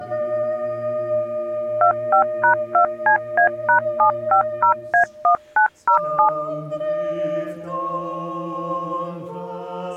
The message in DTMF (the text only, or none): 25#2CA#750A1907